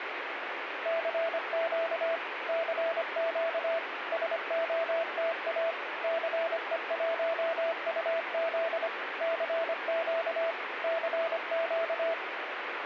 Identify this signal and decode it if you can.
Morse code, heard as a keyed tone, machine-sent, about 25 wpm, 660 Hz, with radio static. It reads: CQ CQ SOTA CE1UZ CQ CQ